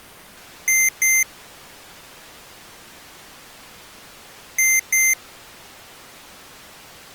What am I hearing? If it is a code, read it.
Beep code, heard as beeps from a small speaker, played twice, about 2100 Hz. 2 short. In AMI BIOS tables: memory parity error; in IBM BIOS tables: self-test error shown on screen; in Dell tables: no memory detected.